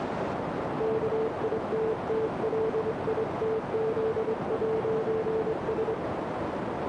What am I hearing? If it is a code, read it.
Morse code, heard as a keyed tone, hand-sent with a straight key, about 24 wpm, 440 Hz, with heavy radio static and a narrow filter. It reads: KITTLITZ'S